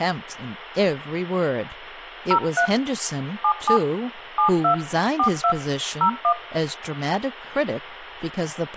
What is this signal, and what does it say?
DTMF, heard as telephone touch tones, dialled by hand, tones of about 90 ms, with phone line noise, room echo and speech in English. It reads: 03 77 72 42 01